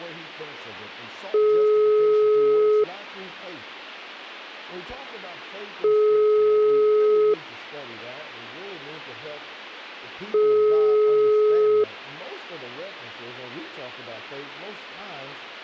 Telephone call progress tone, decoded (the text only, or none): ringback tone